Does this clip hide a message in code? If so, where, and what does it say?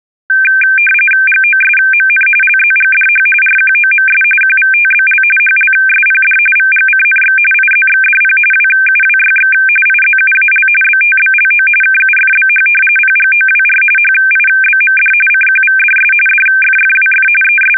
Yes: RTTY (45.45 baud, 850 Hz shift) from 0.3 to 17.8 s, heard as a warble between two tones, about 1950 Hz centre. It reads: GOSMN LZGDH RQOMS QVTBL HLSPD VGCNX IZXDP WUWYX IZUAL BTBLO KUFBH PGOWR HIBMD CQVDS DFFWF …